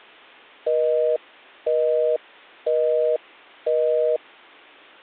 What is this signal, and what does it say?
Telephone call progress tone (North American plan), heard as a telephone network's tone, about 480, 620 Hz, 0.5 s on and 0.5 s off. Busy tone.